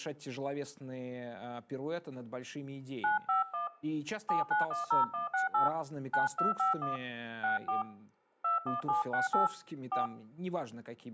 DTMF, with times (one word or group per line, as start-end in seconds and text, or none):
3.0-3.7 951
4.3-5.7 7910168
6.1-7.0 9251
7.4-7.8 64
8.4-9.5 21768
9.9-10.1 4